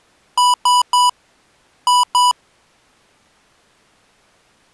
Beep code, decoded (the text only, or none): 3-2